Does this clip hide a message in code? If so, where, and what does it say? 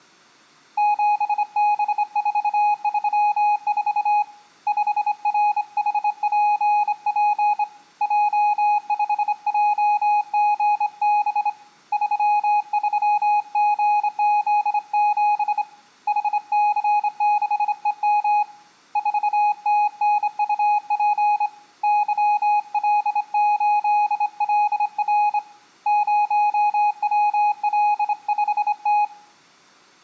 Yes: Morse code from 0.7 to 29.1 s, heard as a keyed tone, hand-sent with a straight key, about 26 wpm, 830 Hz, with room echo. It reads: 7B434 5RHPP J5JGB 33GZ7 HC6EM 4TNUP YL8LR 0WL5T